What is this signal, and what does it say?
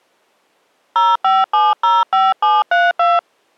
DTMF, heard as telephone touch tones, dialled by hand, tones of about 200 ms. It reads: 05705732